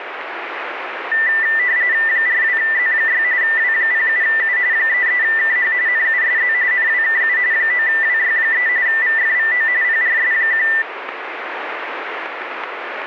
RTTY (45.45 baud, 170 Hz shift), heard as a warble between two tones, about 1900 Hz centre, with radio static. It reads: 42Z6 W07U 33KH NUSZ NWKU 9WY3 VFVO PRS1